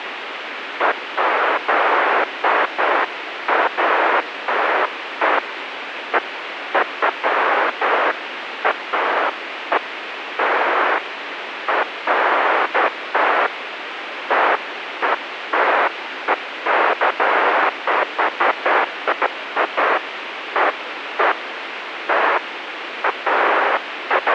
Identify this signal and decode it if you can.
Bursts of noise, with radio hiss. There is no code.